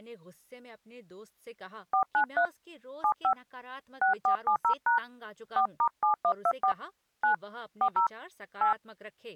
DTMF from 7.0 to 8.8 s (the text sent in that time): 9 40 8